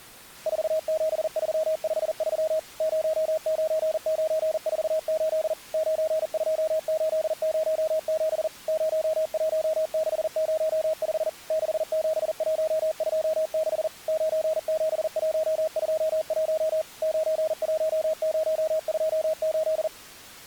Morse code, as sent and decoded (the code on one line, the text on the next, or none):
....- --... ...-- ..... ...-- / ----- ----. ----. ....- ---.. / ----. ..--- ---.. ----- --... / ----- .---- -.... ----- ..... / -.... --... .---- ..--- -.... / ----. --... .---- ..--- .---- / ----. .---- ----- ..--- ---..
47353 09948 92807 01605 67126 97121 91028